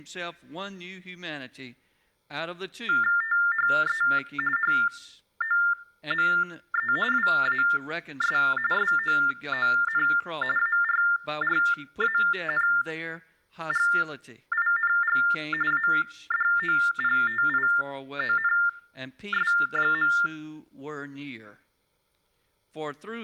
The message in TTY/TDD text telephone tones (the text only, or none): THE HOME WAS SOON ARRANGING ADOPTIONS.